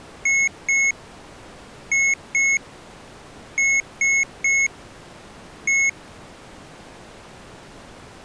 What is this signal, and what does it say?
Beep code, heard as beeps from a small speaker, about 2200 Hz. 2-2-3-1. In Phoenix BIOS tables: unexpected interrupt.